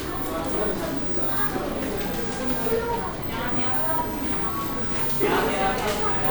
The noise of a cafe. There is no code.